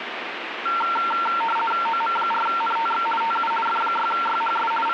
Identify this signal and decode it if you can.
RTTY (50 baud, 450 Hz shift), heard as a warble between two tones, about 1140 Hz centre, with radio static. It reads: OM4NTX TU F6YHS …